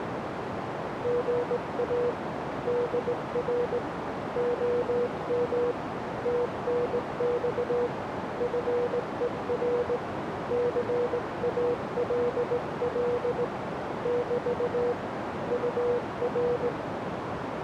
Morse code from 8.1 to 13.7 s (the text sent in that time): FER CALL